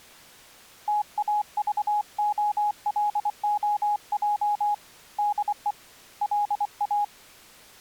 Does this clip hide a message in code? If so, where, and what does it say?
Yes: Morse code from 0.8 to 7.1 s, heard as a keyed tone, hand-sent with a paddle, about 24 wpm, 830 Hz. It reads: TAVOLOJ DE LA